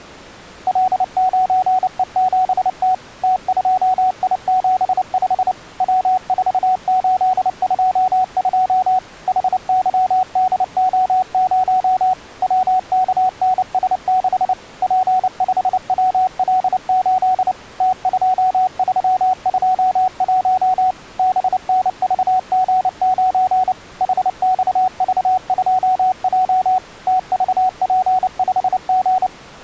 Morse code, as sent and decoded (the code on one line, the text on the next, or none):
.-.. ----. . --... - / - ..--- .. --... ..... / .-- ....- ---.. ..--- ..--- / .... -.-- -.. --- ----- / .-- -.- -. ... -.... / .--. ..... .-- .-.. ---.. / - ..--- ...-- ..--- .---- / -... -. ...- --. ----. / .... -..- ...- ..--- .--- / - ...- .--. ..... --.
L9E7T T2I75 W4822 HYDO0 WKNS6 P5WL8 T2321 BNVG9 HXV2J TVP5G